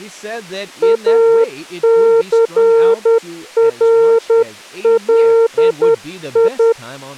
Morse code, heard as a keyed tone, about 10 wpm, 460 Hz, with speech in English. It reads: ACRLI